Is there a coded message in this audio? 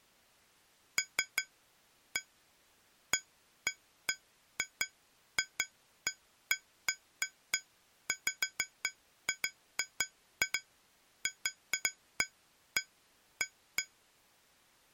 No, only irregular taps on glass.